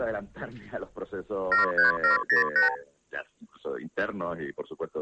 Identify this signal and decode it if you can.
Multi-frequency trunk signalling (R2, with the far end's replies), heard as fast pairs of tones, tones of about 130 ms. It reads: 73708